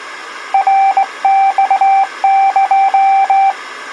Morse code (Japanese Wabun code), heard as a keyed tone, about 18 wpm, 780 Hz. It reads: ナマエ